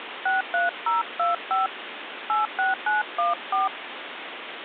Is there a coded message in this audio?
Yes: DTMF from 0.3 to 3.7 s, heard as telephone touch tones, dialled by hand, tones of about 150 ms, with phone line noise. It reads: 63025 86914